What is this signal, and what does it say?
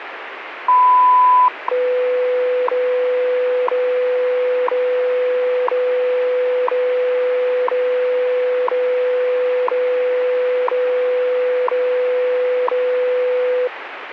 Radio time signal (WWV, Colorado), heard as ticks, one a second, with radio static.